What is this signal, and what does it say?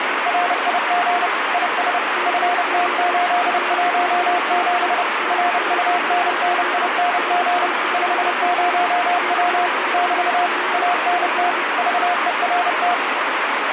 Morse code, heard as two keyed tones, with radio static. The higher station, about 30 wpm, 710 Hz: RIG IS FT817 RUNNING 50W <BT> ANT VERT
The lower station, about 33 wpm, 360 Hz: CQ POTA RA3Z RA3Z RA3Z <AR>